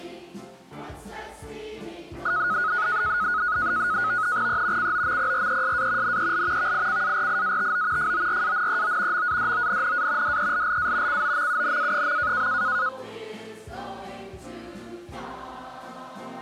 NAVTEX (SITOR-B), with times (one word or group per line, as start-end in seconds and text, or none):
4.5-4.9 E
4.8-6.2 COMPRESA
6.0-6.7 NEL
6.6-8.1 VICARIATO
8.0-9.3 FORANEO
9.1-10.4 MADONNA
10.2-11.2 DELLA
11.1-12.5 COMUNA.